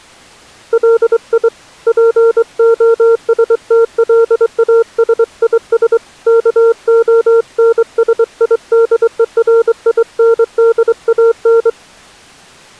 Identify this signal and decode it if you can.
Morse code, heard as a keyed tone, hand-sent with a straight key, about 23 wpm, 460 Hz. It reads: LI POSTLASIS KONSIDERINDAN